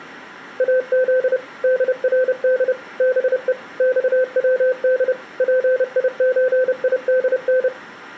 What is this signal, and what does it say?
Morse code (Persian alphabet), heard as a keyed tone, machine-sent, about 30 wpm, 510 Hz. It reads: از درد به خود پیچیدن